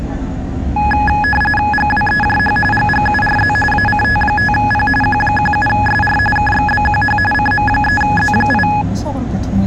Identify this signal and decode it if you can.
RTTY (45.45 baud, 850 Hz shift), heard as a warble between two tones, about 1260 Hz centre, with the noise inside a bus. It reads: GWEJH GGURZ ACT5P Q17SR KXBQH CM3Z8